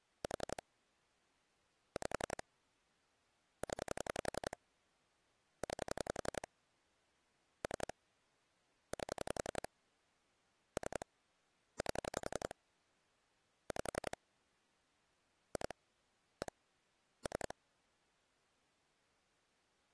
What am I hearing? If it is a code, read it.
Pulse dialling, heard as clicks on a phone line, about 11 pulses a second. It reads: 4 5 0 9 3 8 3 8 5 2 1 3